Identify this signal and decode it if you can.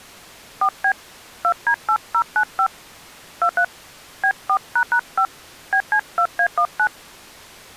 DTMF, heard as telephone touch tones, dialled by hand, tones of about 80 ms. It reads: 4B 2D8095 23 B4##5 BC2A19